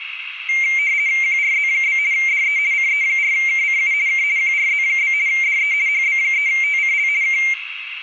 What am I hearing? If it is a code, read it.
RTTY (50 baud, 170 Hz shift), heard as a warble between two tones, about 2200 Hz centre, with radio static, a narrow filter and room echo. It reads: QRZ? DE CE4KCU K QRZ? DE HB3TCL K